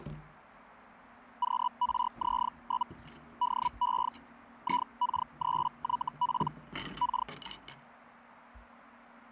Hellschreiber (Feld-Hell, 122.5 baud), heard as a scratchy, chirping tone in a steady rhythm, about 980 Hz, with kitchen noise. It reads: QRZ? DE IK3YP K